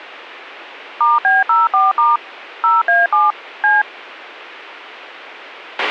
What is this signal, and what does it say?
DTMF, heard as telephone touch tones, dialled by machine, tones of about 180 ms, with a squelch burst at the end. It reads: *B04* 0A7 C